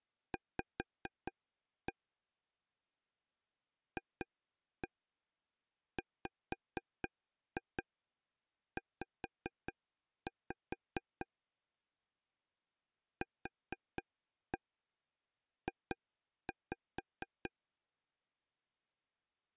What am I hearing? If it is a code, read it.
Tap code, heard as taps on a table, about 4 knocks a second. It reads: V FWZ QJ